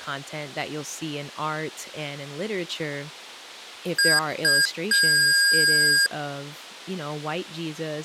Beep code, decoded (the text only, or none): 2 short, 1 long